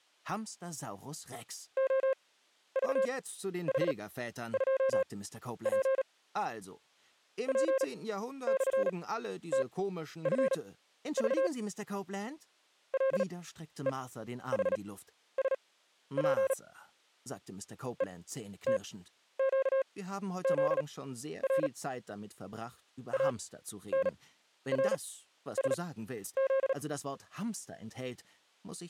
Morse code, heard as a keyed tone, machine-sent, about 37 wpm, spaced as for 12 wpm, 530 Hz. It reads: OVH2P P/TFV LEHSP ETQZR ANRSZ